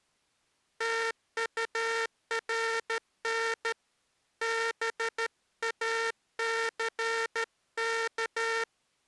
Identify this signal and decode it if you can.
Morse code, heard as a buzzer, hand-sent with a straight key, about 13 wpm. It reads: TURN BACK